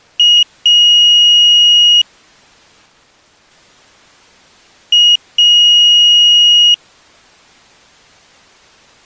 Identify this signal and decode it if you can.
Beep code, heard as a piezo beeper, played twice, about 2900 Hz. 1 short, 1 long.